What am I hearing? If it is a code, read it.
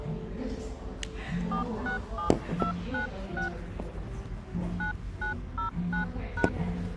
DTMF, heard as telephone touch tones, dialled by hand, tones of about 120 ms, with the noise of a cafe. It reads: 467296 9909#